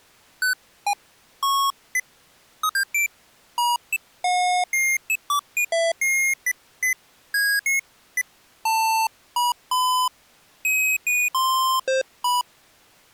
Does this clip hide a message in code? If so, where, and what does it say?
No, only electronic bleeps of random pitch and length.